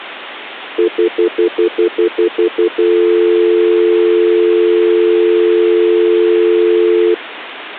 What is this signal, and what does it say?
Telephone call progress tone (North American plan), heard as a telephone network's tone, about 350, 440 Hz, 0.1 s on and 0.1 s off. Stutter dial tone.